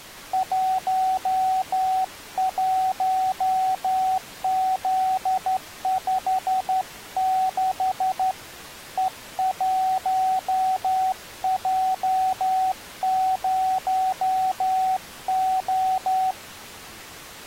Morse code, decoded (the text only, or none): 11Z56 E1J0O